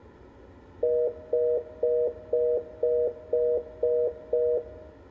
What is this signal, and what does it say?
Telephone call progress tone (North American plan), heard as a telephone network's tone, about 480, 620 Hz, 0.25 s on and 0.25 s off, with room echo. Congestion tone.